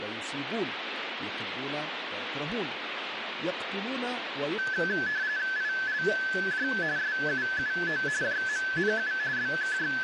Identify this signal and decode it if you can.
RTTY (45.45 baud, 170 Hz shift), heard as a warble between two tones, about 1650 Hz centre, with radio static. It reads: ILJ SUUO JMNU …